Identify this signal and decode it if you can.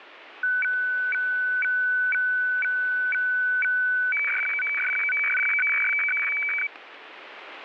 Weather fax (radiofax), 120 lines a minute, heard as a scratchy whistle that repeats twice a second, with radio static.